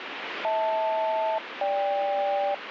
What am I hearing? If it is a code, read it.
Aircraft SELCAL, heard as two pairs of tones, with radio static. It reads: HL-GK